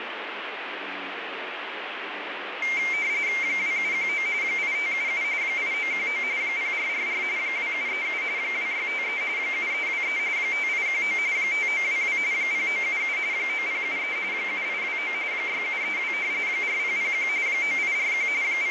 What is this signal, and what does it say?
RTTY (45.45 baud, 170 Hz shift), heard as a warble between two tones, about 2200 Hz centre, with radio static. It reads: 2719 8577 8919 0444 2737 2653 7323 5819 5922 0977 9073 7829 6732 4001 9841 …